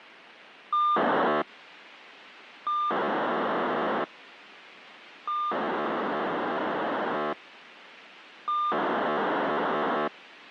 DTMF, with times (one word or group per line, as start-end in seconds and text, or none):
none